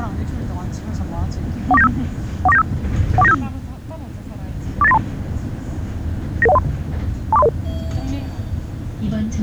Five-tone selective call (EIA), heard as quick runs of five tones, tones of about 30 ms, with the noise inside a bus. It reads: 14975 14975 14975 48932 99103 24300